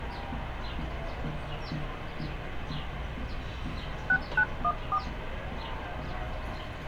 DTMF, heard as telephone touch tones, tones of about 60 ms, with street noise. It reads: 6914